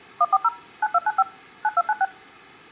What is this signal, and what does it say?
DTMF, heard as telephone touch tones, dialled by machine, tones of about 40 ms. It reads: 140 9295 9296